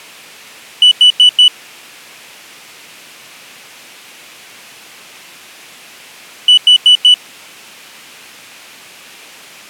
Alarm pattern, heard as an alarm's beeps, played twice, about 2950 Hz. Temporal four. Carbon monoxide.